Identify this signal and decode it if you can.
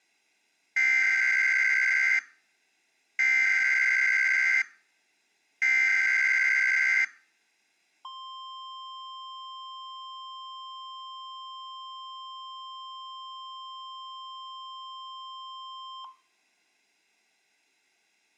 Emergency Alert System (SAME) tones (header bursts, then the 1050 Hz attention tone), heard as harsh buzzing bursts, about 520.83 baud.